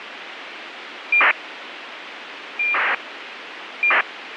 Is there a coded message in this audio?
Yes: ACARS aircraft data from 1.1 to 4.0 s, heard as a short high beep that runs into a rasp, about 2400 baud, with radio hiss.